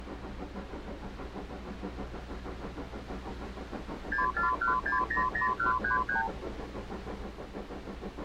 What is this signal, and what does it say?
Multi-frequency trunk signalling (R2, with the far end's replies), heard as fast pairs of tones, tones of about 120 ms. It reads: 641600133